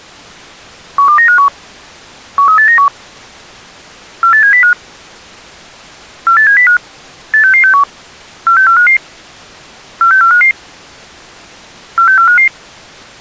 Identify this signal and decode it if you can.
Five-tone selective call (CCIR), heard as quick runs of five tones, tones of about 100 ms. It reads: 12951 13891 48705 48705 86661 46455 46455 46455